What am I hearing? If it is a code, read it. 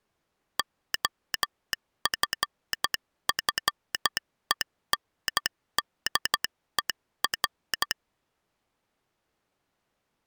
Morse code, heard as a telegraph sounder, hand-sent with a straight key, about 12 wpm. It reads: OFFENDER